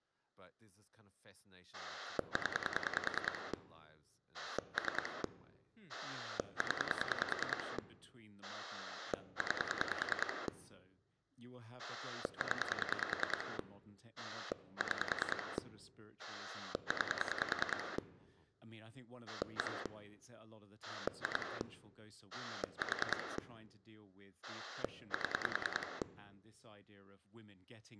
Pulse dialling, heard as a rotary dial, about 10 pulses a second, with speech in English. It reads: 0 3 0 9 0 6 9 1 2 4 7